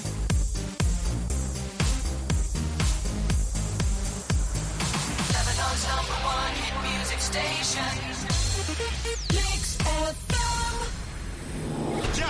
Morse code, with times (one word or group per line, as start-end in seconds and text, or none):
none